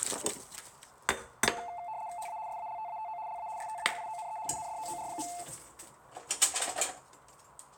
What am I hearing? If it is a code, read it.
RTTY (75 baud, 170 Hz shift), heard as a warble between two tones, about 790 Hz centre, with kitchen noise. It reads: HA SALTATO LA STAGIONE INDOOR.